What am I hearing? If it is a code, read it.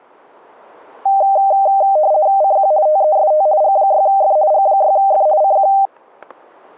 RTTY (50 baud, 170 Hz shift), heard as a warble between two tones, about 700 Hz centre, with static crashes. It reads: CQ TEST G6F G6F CQ